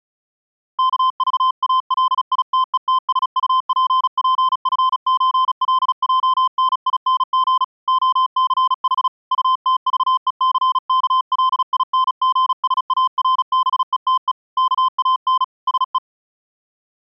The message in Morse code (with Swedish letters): KVALITETSUPPFÖLJNING OCH UTVECKLINGSARBETE KAN SE

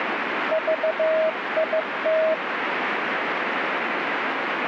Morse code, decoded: VIT

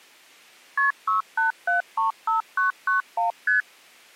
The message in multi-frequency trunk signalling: KP 68735991 ST

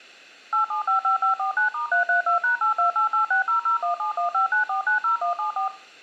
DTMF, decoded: 8755549*332#828860017159490174

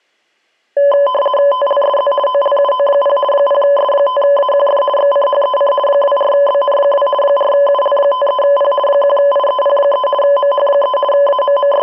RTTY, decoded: TLSZ OLUO0 0S5AQF XCHEC 24BN2 4UL53P 1IEP3 MH3 …

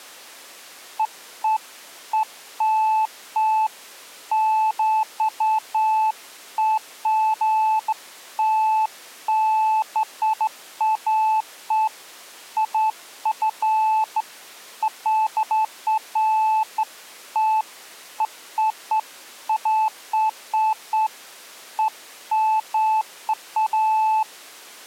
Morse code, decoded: none

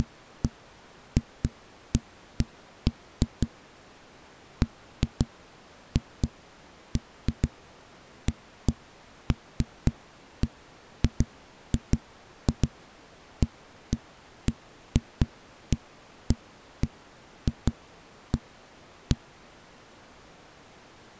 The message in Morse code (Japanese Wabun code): none

